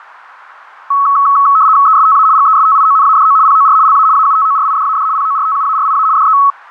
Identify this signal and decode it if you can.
RTTY (75 baud, 170 Hz shift), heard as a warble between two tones, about 1200 Hz centre. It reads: ESTA GESTIONADO POR LA AUTORIDAD PORTUARIA DE